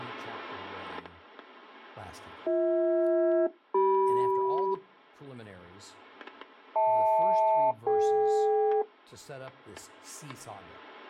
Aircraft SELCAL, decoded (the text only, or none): BH-CM HL-DK